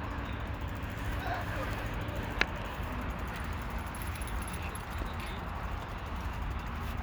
The noise of a park. There is no code.